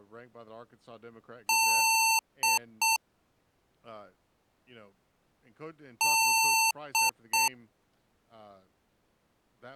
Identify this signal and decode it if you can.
Beep code, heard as beeps from a small speaker, played twice, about 900 Hz, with speech in English. 1 long, 2 short. In Award, IBM and AMI BIOS tables: video adapter failure.